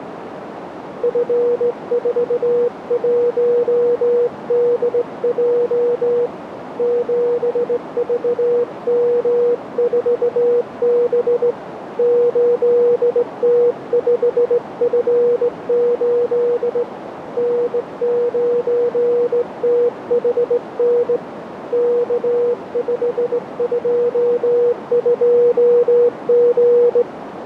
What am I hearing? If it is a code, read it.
Morse code, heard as a keyed tone, hand-sent with a straight key, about 18 wpm, 480 Hz, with radio static and a narrow filter. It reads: F41DJ 7VM4B 8T5F8 N9THN K522G